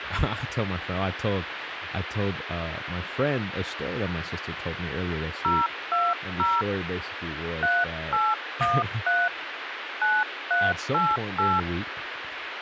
DTMF, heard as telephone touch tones, dialled by hand, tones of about 220 ms, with radio hiss and speech in English. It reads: 020 3813 9388